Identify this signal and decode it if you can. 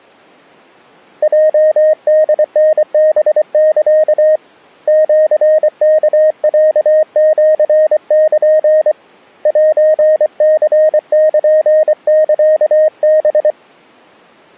Morse code (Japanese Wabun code), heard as a keyed tone, hand-sent with a paddle, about 24 wpm, 620 Hz. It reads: ヲホタハサ シワロシル セニルサハ